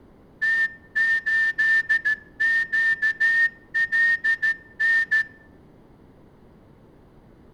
Morse code, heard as a whistle, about 14 wpm, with room echo. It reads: T8QLN